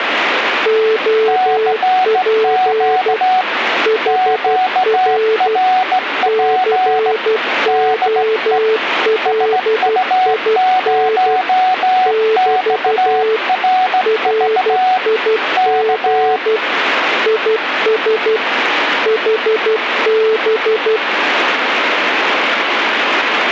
Morse code, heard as two keyed tones, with radio static. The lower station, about 12 wpm, 440 Hz: OP HR COLIN <BT> RIG IS HB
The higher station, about 17 wpm, 740 Hz: CQ QRP DE SU0XRV K